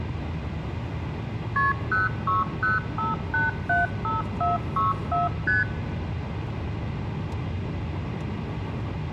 Multi-frequency trunk signalling (R1, as on North American trunks), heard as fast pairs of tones, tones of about 160 ms, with room echo and the noise inside a car. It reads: KP 0605875464 ST